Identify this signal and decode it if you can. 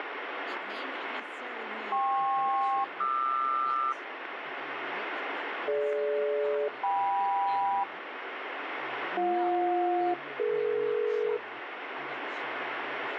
Aircraft SELCAL, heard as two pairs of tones, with radio static and speech in English. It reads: KP-QR DG-KM BJ-DE